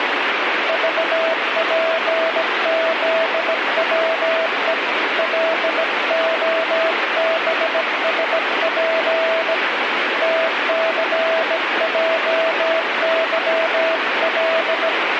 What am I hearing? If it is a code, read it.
Morse code, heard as a keyed tone, hand-sent with a bug key, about 17 wpm, 650 Hz, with radio static. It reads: VPZWE LOBSP TCJYL